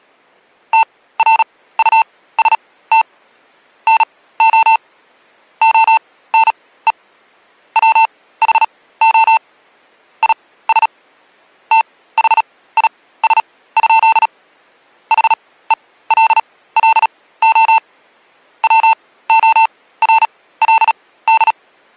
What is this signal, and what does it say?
Morse code, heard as electronic beeps, machine-sent, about 37 wpm, spaced as for 18 wpm, 890 Hz. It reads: TRUST NO ONE WHO IS THIS? HELLO WORLD